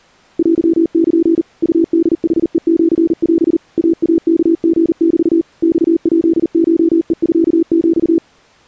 Morse code (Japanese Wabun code), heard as a keyed tone, machine-sent, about 39 wpm, 330 Hz. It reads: テル ウホヌヘシオ イイワリメ マヱコヘミヒ